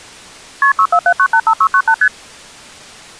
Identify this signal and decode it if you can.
Multi-frequency trunk signalling (R1, as on North American trunks), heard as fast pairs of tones, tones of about 70 ms. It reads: KP 647985698 ST